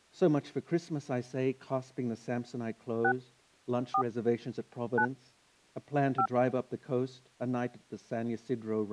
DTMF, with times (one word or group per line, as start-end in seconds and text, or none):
3.0-3.1 6
3.9-4.0 4
5.0-5.1 9
6.2-6.3 5